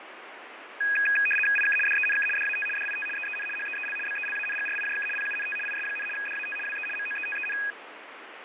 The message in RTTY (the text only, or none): IK DENK DAT DIT EEN HEEL BELANGRIJK PUNT IS, DAT WE MOETEN